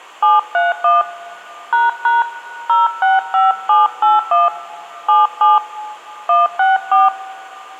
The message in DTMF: 731 ## 065781 77 164

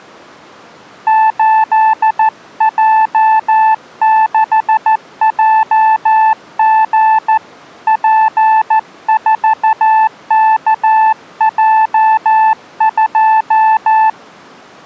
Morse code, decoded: 8J6JG P4KJ2

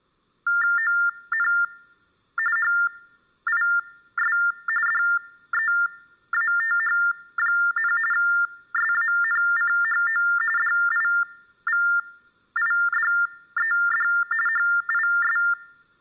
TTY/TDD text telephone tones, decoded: ON HIS DEATH, SANCHO DIVIDED HIS

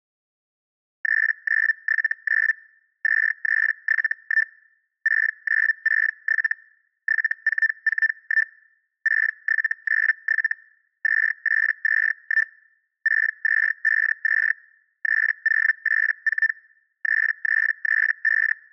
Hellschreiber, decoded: 3979 2371 6967 7441 6797 2821 6252 3084 3335

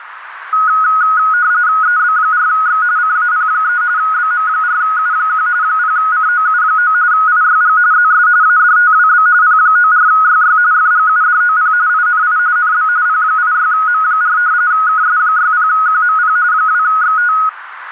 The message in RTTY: EB4X CAP3 BM4U1 0COU9 IYG ZS ADTWB P94YY FGUDOP INI NB P86M4 KS60QMP 2XT

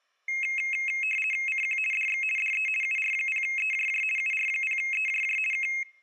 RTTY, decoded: CQ DX DE UR0EJJ UR0EJJ K

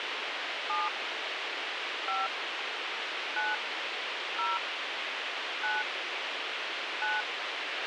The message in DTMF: 7 5 9 0 9 9

